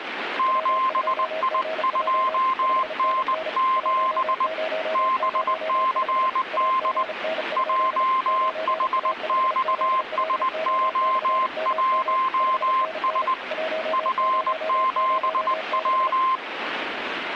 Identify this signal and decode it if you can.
Morse code, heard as two keyed tones, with radio static. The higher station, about 20 wpm, 1050 Hz: 7I2N7 BCD JHXSO1S F7W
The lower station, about 35 wpm, 640 Hz: W2GJ 5NN 1005 AGN? 9A5ZLO/MM 5NN 1006